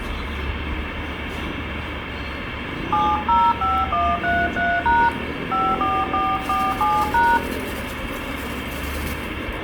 DTMF, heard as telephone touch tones, dialled by hand, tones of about 230 ms, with phone line noise and the noise of a residential street. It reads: 705133# 54447#